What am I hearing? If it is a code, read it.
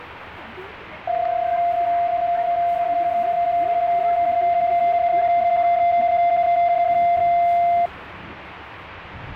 PSK31 (31.25 baud), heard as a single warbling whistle, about 690 Hz, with radio static and the noise inside a bus.